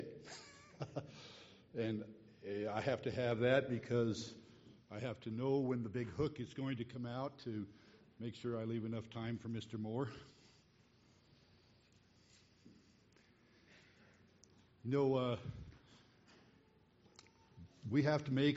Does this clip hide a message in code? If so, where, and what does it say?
No.